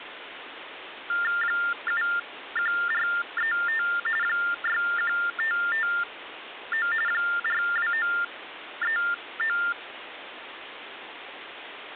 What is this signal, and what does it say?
TTY/TDD text telephone tones (45.45 baud Baudot), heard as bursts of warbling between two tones, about 400 Hz shift, 1600 Hz centre, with phone line noise. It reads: 71435 61559 42939